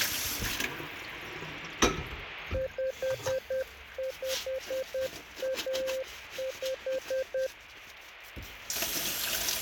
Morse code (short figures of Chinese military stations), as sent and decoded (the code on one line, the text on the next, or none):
..... ..... .- .....
5515